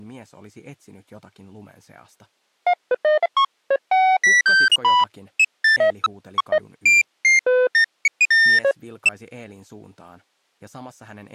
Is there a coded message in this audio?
No, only electronic bleeps of random pitch and length.